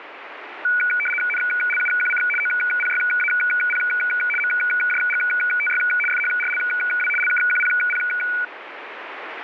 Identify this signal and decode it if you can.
RTTY (75 baud, 850 Hz shift), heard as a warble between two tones, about 1900 Hz centre, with radio static. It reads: NLUQC OPYAP MJGTY FHRLW LKQPP